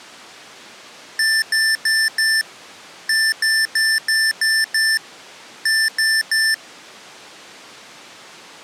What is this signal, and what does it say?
Beep code, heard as beeps from a small speaker, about 1750 Hz. 4-6-3.